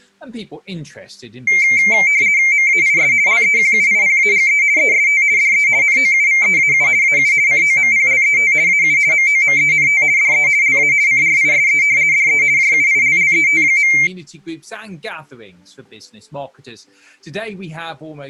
RTTY (50 baud, 170 Hz shift), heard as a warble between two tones, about 2200 Hz centre. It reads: MAIS LEQUIPAGE EST DE NOUVEAU AU COMPLET AU MOMENT DE LA CRISE DE JUILLET.